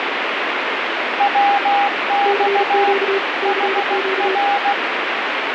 Morse code, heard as two keyed tones, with heavy radio static. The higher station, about 16 wpm, 810 Hz: WX HR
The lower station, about 35 wpm, 390 Hz: CQ CQ